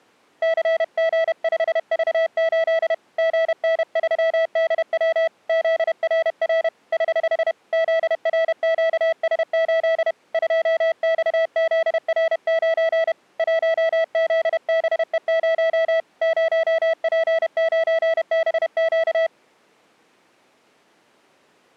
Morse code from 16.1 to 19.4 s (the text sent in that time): 0P9BQ